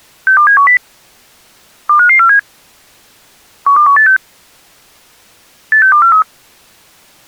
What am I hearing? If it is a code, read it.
Five-tone selective call (CCIR), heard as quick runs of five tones, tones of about 100 ms. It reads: 62710 25547 12186 86243